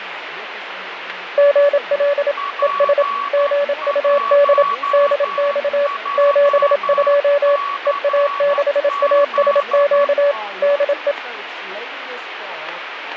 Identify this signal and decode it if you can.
Morse code, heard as two keyed tones, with radio static. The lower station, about 27 wpm, 570 Hz: GL ES GUD DX 72 EA6ASQ DE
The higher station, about 11 wpm, 1130 Hz: P1JCZ